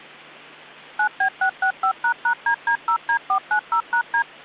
DTMF, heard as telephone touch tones, dialled by machine, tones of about 90 ms, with hum. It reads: 9B665##DD0D490#D